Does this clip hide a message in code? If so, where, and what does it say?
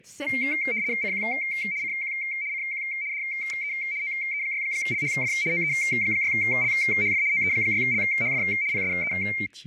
Yes: RTTY (75 baud, 170 Hz shift) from 0.3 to 9.5 s, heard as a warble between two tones, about 2200 Hz centre, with speech in French. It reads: CQ CQ CQ DE OE6LHF OE6LHF OE6LHF PSE